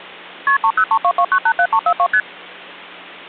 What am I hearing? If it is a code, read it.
Multi-frequency trunk signalling (R1, as on North American trunks), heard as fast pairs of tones, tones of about 70 ms, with hum. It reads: KP 30322987342 ST